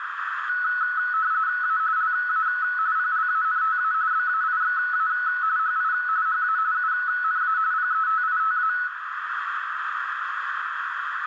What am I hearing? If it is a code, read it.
RTTY (45.45 baud, 170 Hz shift), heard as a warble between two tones, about 1380 Hz centre, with radio static and a narrow filter. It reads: A LA PLANTA BAIXA HI HA UNA PETITA